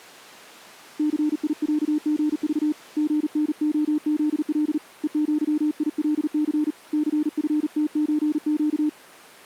Morse code (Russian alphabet), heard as a keyed tone, hand-sent with a paddle, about 39 wpm, 300 Hz. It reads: ЦИЯГЖ ГНОЗЛ ЕЪИЛЦ ЦФТЧЩ